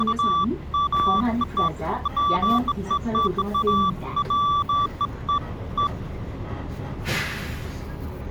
Beeps of irregular length, with the noise inside a bus. There is no code.